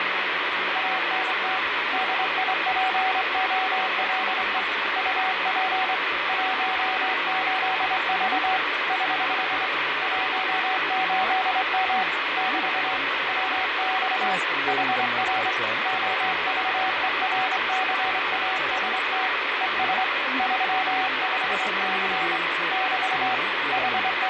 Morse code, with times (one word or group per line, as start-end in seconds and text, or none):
0.8-1.6 ANT
1.9-4.6 DIPOLE
5.0-5.9 UP
6.3-8.6 18V
8.9-9.7 <HH>
10.0-12.0 18M
12.4-13.0 <BT>
13.3-14.3 WX
14.7-15.5 HR
15.9-19.3 OVERCAST
19.6-20.0 ES
20.4-22.4 35C
22.7-23.3 <BT>
23.7-24.3 …